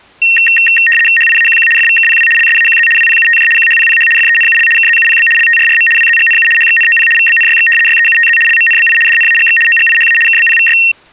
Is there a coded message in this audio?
Yes: RTTY (75 baud, 850 Hz shift) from 0.2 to 10.9 s, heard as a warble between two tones, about 2300 Hz centre. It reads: HIAQQ FVKPW LSAQZ WPUTJ QHPPH FENUL KZUPB LTRRM WZGNU HXNOP VBNYX YEUTZ LMNBI DNAGX OGIHA KBPVY